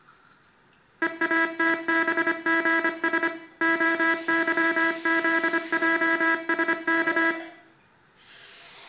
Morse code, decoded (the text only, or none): EATBGS OYZJSK